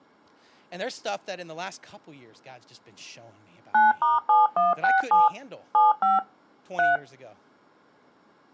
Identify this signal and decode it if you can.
DTMF, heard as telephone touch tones, dialled by machine, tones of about 170 ms, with speech in English. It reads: 9*7167 75 3